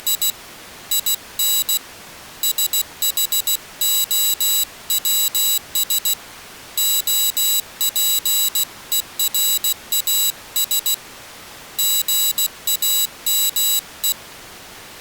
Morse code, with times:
0.0-0.3 …
0.9-1.8 IN
2.4-6.1 SHOWS
6.8-10.9 OPERAS
11.8-14.1 GAME

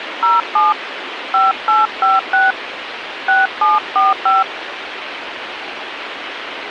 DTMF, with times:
0.2-0.7 07
1.3-2.5 5856
3.3-4.4 6745

